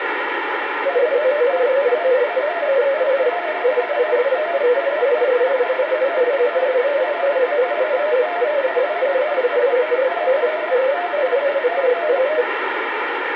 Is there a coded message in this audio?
Yes: multi-tone FSK (Olivia or MFSK type), about 250 Hz wide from 0.8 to 12.5 s, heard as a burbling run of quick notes, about 31.25 baud, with radio static and room echo.